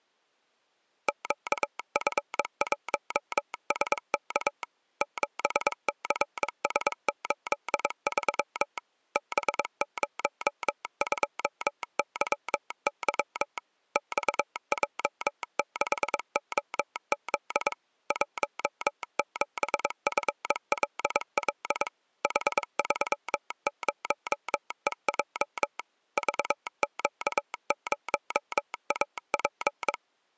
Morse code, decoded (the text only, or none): QF1SK 7CS83 B02YY XJ6OZ 17FLL H30EJ VQ0AP